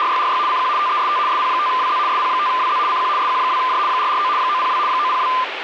RTTY (75 baud, 170 Hz shift), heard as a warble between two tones, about 1110 Hz centre, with radio static. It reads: … CQ TEST SP5WZ SP5WZ CQ SQ2J 449 902 902